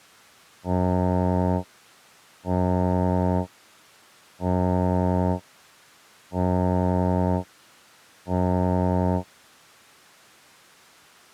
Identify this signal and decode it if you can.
Ship horn signal, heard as a ship's horn, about 90 Hz. 5 short. At sea: I doubt that you are doing enough to avoid a collision.